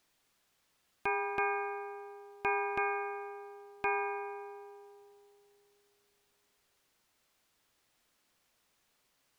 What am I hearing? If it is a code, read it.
Ship's bell, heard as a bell. 5. Five half-hours of the watch have passed.